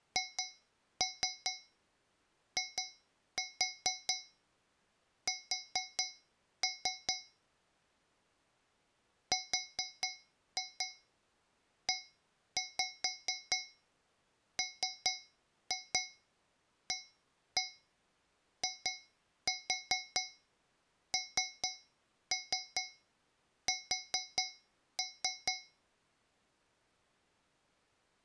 Tap code, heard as taps on a metal pipe, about 4 knocks a second. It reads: HIS REMAINS